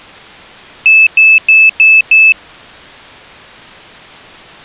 Beep code, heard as a piezo beeper, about 2600 Hz. 5 short. In AMI BIOS tables: processor failure; in Dell tables: CMOS battery failure.